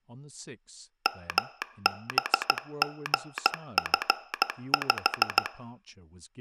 Morse code, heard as a telegraph sounder, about 15 wpm, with speech in English. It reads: MBGF5